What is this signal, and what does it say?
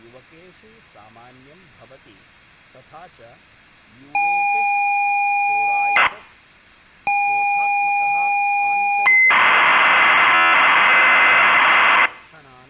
ZX Spectrum tape loading, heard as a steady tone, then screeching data, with speech in Sanskrit.